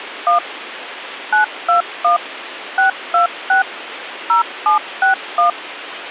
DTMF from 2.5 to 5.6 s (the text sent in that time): 626 0761